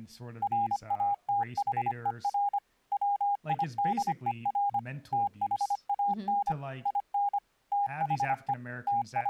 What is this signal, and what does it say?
Morse code, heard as a keyed tone, machine-sent, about 25 wpm, 810 Hz, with speech in English. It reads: RATHER WIDER THAN IN THE …